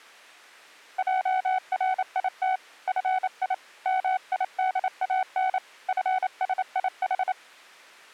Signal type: Morse code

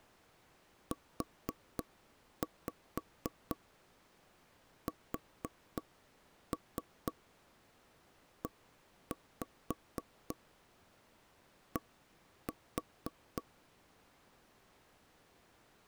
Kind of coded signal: tap code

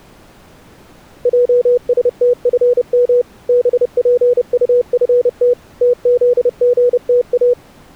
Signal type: Morse code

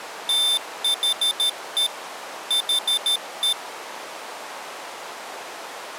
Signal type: Morse code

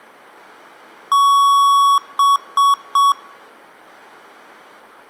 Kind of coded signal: beep code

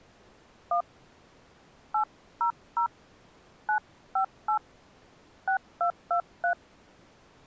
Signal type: DTMF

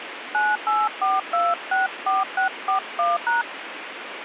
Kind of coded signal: DTMF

